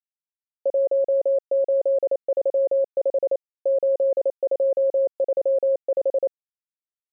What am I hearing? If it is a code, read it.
Morse code, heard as a keyed tone, machine-sent, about 28 wpm, 540 Hz. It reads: 1835 8235